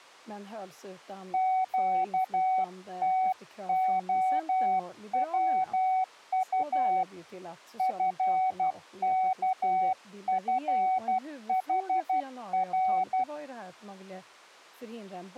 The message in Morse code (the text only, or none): QTOWU FKFHR